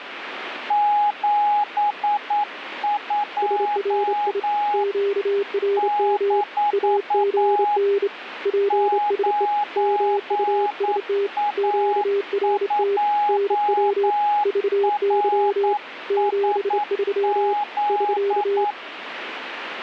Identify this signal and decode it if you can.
Morse code, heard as two keyed tones, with radio static. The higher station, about 9 wpm, 830 Hz: 72 - 9A2RSZ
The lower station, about 28 wpm, 400 Hz: SRI QRM AGN PSE MUST QRT NW VY 73 <SK>